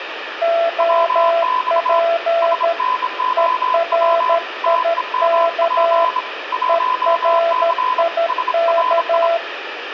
Morse code, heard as two keyed tones, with radio static and room echo. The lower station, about 13 wpm, 670 Hz: OP ERIK ERIK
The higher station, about 26 wpm, 1010 Hz: WX SNOW TEMP 1C SRI